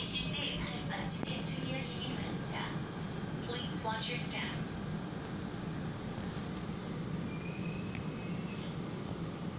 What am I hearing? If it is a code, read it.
The noise inside a subway train. There is no code.